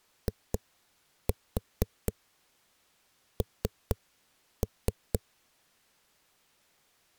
Tap code, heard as knocks on a wall, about 4 knocks a second. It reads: IN